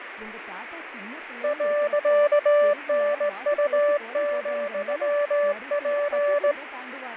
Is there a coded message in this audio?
Yes: Morse code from 1.4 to 6.6 s, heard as a keyed tone, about 18 wpm, 580 Hz, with radio static, fading and speech in Tamil. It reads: .NU,P